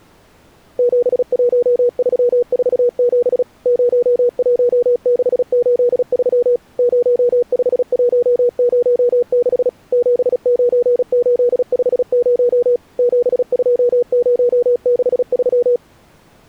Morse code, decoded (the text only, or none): 71347 01683 05106 79850 72063